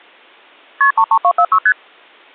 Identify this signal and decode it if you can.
Multi-frequency trunk signalling (R1, as on North American trunks), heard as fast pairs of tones, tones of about 70 ms. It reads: KP 33246 ST